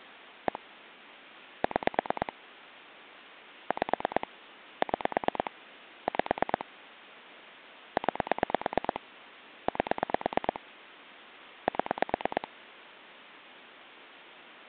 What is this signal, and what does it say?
Pulse dialling, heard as clicks on a phone line, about 9 pulses a second. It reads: 1 6 5 6 5 9 8 7